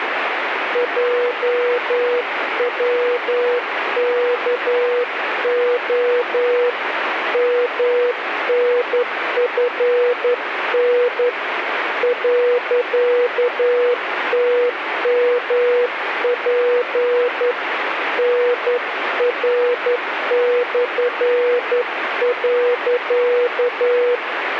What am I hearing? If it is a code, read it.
Morse code, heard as a keyed tone, hand-sent with a straight key, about 11 wpm, 490 Hz, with radio static. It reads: JWKO MNFN .TMP NR/.